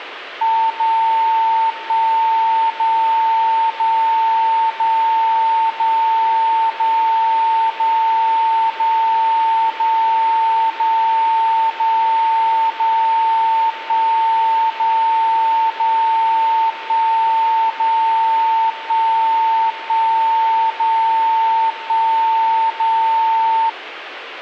Radio time signal (DCF77), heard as a tone whose level steps once a second, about 900 Hz, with radio static. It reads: 0 1 0 0 0 0 0 0 0 0 0 0 0 1 0 0 1 0 1 1 0 1 0